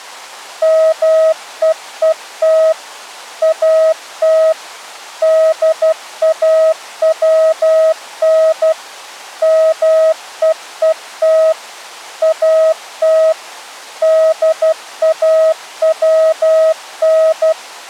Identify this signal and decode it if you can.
Morse code, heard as a keyed tone, machine-sent, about 12 wpm, 640 Hz. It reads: MEET AT DAWN MEET AT DAWN